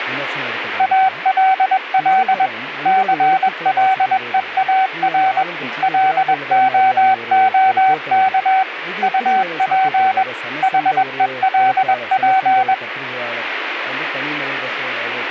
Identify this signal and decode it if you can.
Morse code, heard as a keyed tone, machine-sent, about 21 wpm, 760 Hz, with radio static. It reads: ALL CLEAR LOOK UP HELP